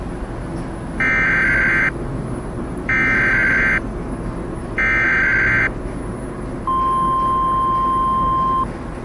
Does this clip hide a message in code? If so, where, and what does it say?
Yes: Emergency Alert System (SAME) tones (header bursts, then the 1050 Hz attention tone) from 1.0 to 8.6 s, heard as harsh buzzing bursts, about 520.83 baud, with the noise inside a lift.